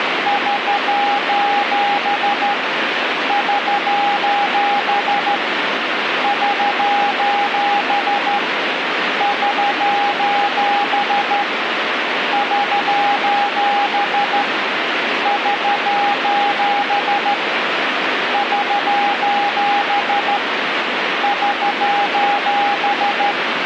Morse code, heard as a keyed tone, hand-sent with a straight key, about 13 wpm, 810 Hz, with radio static. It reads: <SOS> <SOS> <SOS> <SOS> <SOS> <SOS> <SOS> <SOS>